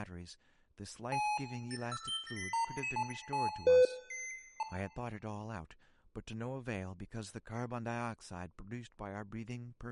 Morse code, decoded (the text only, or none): none